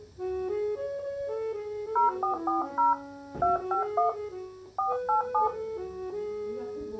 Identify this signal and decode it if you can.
DTMF, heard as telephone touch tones, dialled by hand, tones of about 140 ms. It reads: 0440 251 487